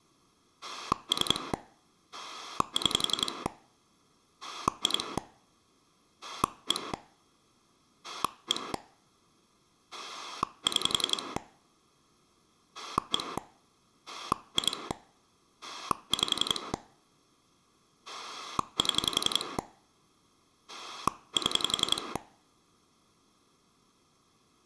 Pulse dialling, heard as a rotary dial, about 11 pulses a second. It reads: 3 6 2 1 1 6 1 2 5 7 7